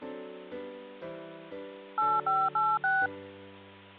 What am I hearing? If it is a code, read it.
DTMF, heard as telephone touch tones, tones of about 220 ms. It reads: 8586